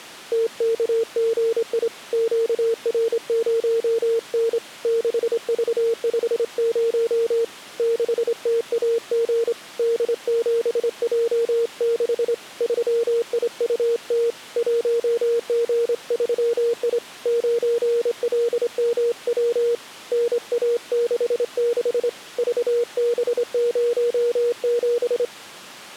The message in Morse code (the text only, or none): TKGI QR0N 6V50 6TAG D7J6 3IUT 1G3I 9LMW NA66 VB07